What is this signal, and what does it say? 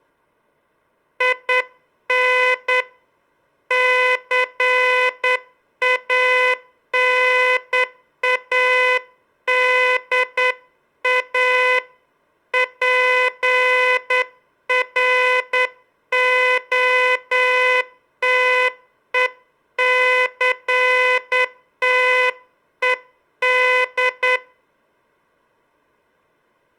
Morse code, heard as a buzzer, hand-sent with a straight key, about 9 wpm. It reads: IN CANADA PROTECTED